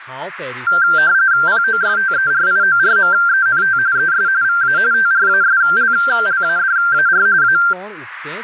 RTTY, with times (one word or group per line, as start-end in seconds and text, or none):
1.5-3.8 POSTERIORMENT
4.0-4.3 ES
4.4-4.8 VA
4.9-7.3 TRASLLADAR
7.4-7.6 A